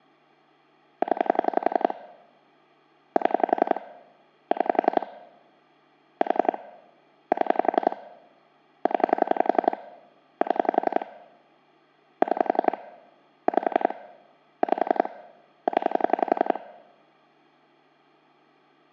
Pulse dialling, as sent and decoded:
10 / 7 / 6 / 4 / 7 / 10 / 7 / 6 / 5 / 5 / 10
0 7 6 4 7 0 7 6 5 5 0

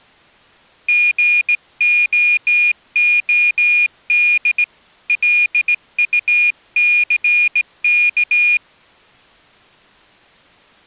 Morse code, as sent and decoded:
--. --- --- -.. / .-.. ..- -.-. -.-
GOOD LUCK

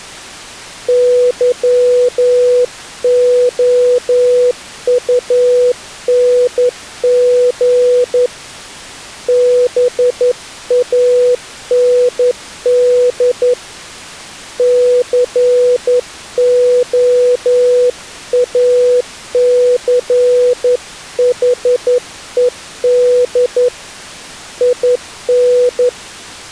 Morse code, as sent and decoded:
-.-- --- ..- -. --. / -... .- -. -.. / -.-. --- .- -.-. .... . -.. / .. -.
YOUNG BAND COACHED IN

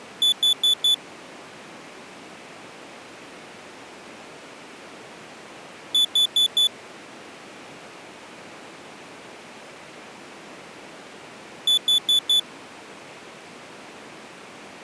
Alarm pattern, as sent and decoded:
4 beeps and a pause
temporal four

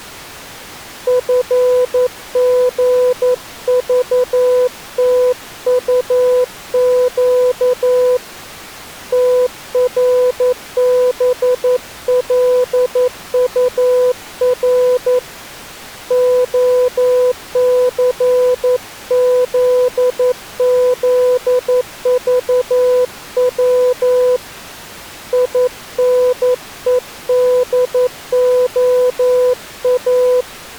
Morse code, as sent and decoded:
..-. --. ...- - ..- --.- / - .-. -... .-.. ..- .-. / --- -.-. --.. --.. ...- .-- / .. -. . -.. --- .-
FGVTUQ TRBLUR OCZZVW INEDOA

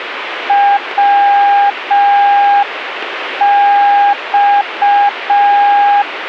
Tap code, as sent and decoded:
none

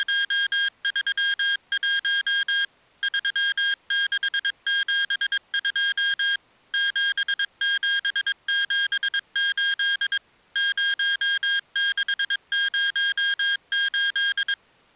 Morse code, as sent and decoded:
… / ...-- -.... --... ..--- / --... --... --... ---.. / ----- -.... ----- ---..
… 3672 7778 0608

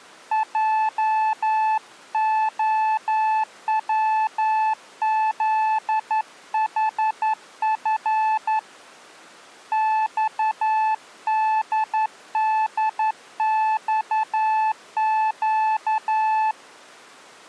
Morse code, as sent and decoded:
.--- --- .-- --.. .... ..-. / -..- -.. -.. -..- --.-
JOWZHF XDDXQ

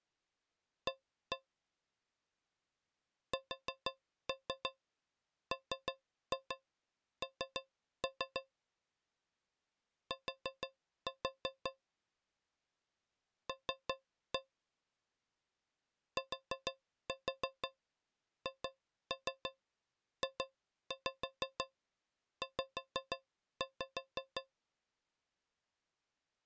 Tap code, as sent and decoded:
1-1 / 4-3 3-2 3-3 / 4-4 / 3-1 / 4-4 2-3 2-5 5-5
A SMN T L THJZ

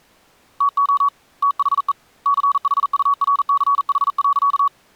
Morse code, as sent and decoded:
- --- / - .... . / -.-. .... ..- .-. -.-. .... .-.-.-
TO THE CHURCH.

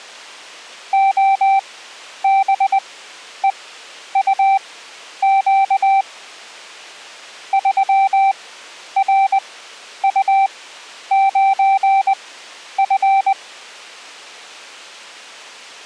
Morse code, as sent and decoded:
--- -... . ..- --.- / ...-- .-. ..- ----. ..-.
OBEUQ 3RU9F

